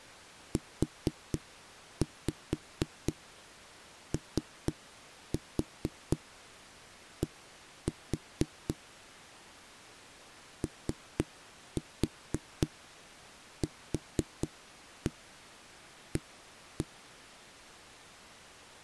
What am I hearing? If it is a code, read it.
Tap code, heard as knocks on a wall, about 4 knocks a second. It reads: UOD OQA